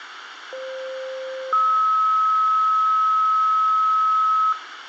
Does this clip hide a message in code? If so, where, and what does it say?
Yes: two-tone page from 0.5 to 4.5 s, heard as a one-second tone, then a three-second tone, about 520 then 1290 Hz, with radio hiss and a squelch burst at the end.